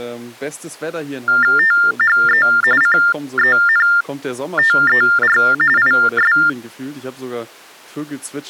TTY/TDD text telephone tones (45.45 baud Baudot), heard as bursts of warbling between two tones, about 400 Hz shift, 1600 Hz centre, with speech in German. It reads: THE CENTER IS